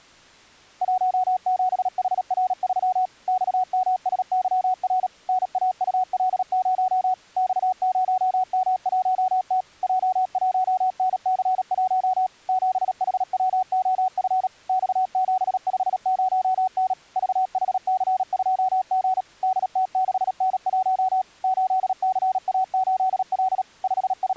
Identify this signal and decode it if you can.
Morse code, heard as a keyed tone, machine-sent, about 37 wpm, 750 Hz. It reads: 17HR3 XMSYR NAUL0 X0M1T J1NC1 7HWOF X750N VHC2G DT6N1 8CA8L …